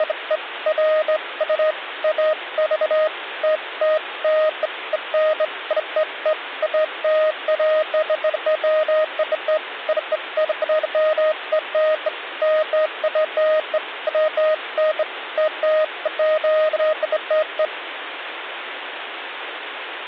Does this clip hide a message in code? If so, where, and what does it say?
No, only beeps of irregular length, with phone line noise.